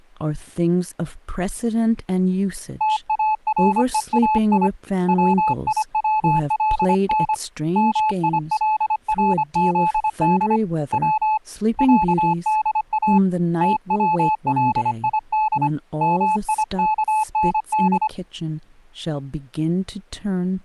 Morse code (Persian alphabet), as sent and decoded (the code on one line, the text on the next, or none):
- .- .-. . .- .. / .-- .. .-- .-.. -. / -- .. .-.. .-. --.. -.. / .-- / .-.- -.. .- / - .-- .-.. .. -.. / -- .. -.- -. -..
تارهای ویولن میلرزد و صدا تولید میکند